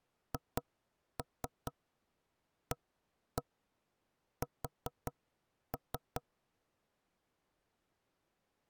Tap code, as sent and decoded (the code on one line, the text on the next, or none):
2-3 1-1 4-3
HAS